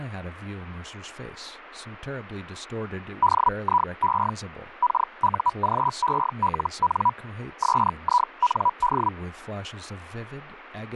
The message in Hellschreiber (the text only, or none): DIE KUGELN SIND